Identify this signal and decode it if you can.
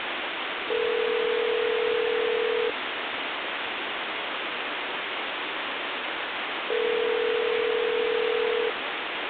Telephone call progress tone (North American plan), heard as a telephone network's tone, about 440, 480 Hz, 2 s on and 4 s off, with phone line noise. Ringback tone.